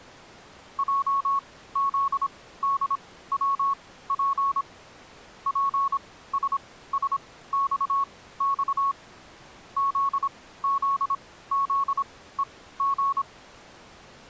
Morse code, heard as a keyed tone, machine-sent, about 26 wpm, spaced as for 16 wpm, 1100 Hz. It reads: JZDWP PSSXX ZZZEG